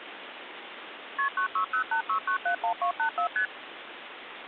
Multi-frequency trunk signalling (R1, as on North American trunks), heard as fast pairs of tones, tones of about 100 ms, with phone line noise. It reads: KP 96086971284 ST